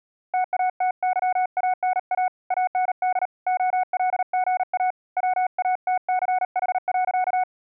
Morse code, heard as a keyed tone, hand-sent with a paddle, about 38 wpm, 740 Hz. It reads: TATYANA AND OLGA WATCH.